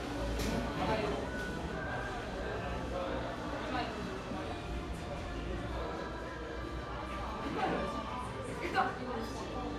The noise of a cafe. There is no code.